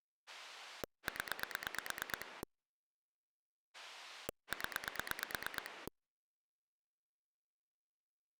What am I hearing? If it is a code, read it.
Pulse dialling, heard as a rotary dial, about 8 pulses a second. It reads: 0 0